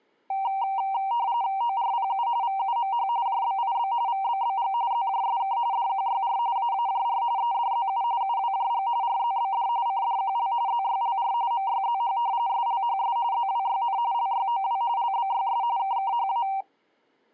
RTTY (45.45 baud, 170 Hz shift), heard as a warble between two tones, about 860 Hz centre. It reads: ORPU VUMH JBIB VBBG ZJSK DQYR AAJR EDZU UWJG RZBD CDQL ZYLR MYZH SLHS ZWYN LYOW LBYS KKHA